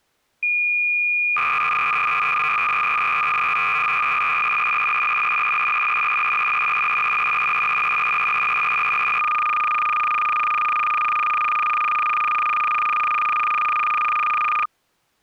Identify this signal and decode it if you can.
Cassette data (Kansas City type), 300 baud, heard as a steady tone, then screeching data.